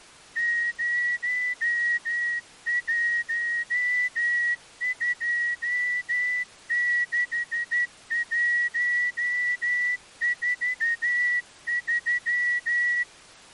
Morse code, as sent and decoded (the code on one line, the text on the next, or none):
----- .---- ..--- -.... .---- ....- ...--
0126143